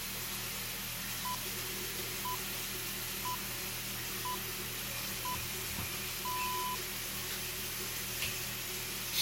Radio time signal (six pips, as the Greenwich Time Signal), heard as pips, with the noise of a restroom.